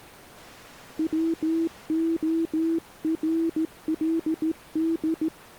Morse code, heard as a keyed tone, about 15 wpm, 330 Hz. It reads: WORLD